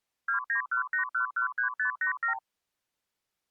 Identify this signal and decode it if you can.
Multi-frequency trunk signalling (R2, with the far end's replies), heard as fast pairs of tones, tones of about 110 ms. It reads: 2918113587